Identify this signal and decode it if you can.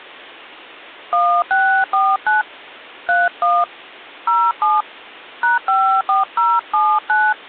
DTMF, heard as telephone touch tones, dialled by hand, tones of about 240 ms. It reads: 1649 31 07 #54079